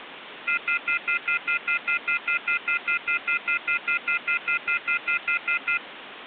Telephone call progress tone (North American plan), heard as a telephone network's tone, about 1400, 2050, 2450, 2600 Hz, 0.1 s on and 0.1 s off, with phone line noise. Off-hook warning tone.